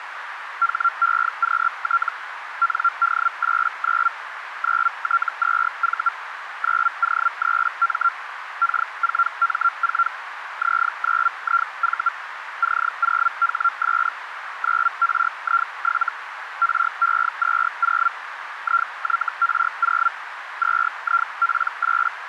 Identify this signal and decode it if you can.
Hellschreiber (Feld-Hell, 122.5 baud), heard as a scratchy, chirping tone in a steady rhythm, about 1370 Hz, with radio static and a narrow filter. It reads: HEQT ND89 9T2V 9O3M K4M4 Z9IV C0HS 9RI7 RE20 IYR0 2IP8